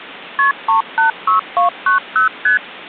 Multi-frequency trunk signalling (R1, as on North American trunks), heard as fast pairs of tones, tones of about 120 ms. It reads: KP 386290 ST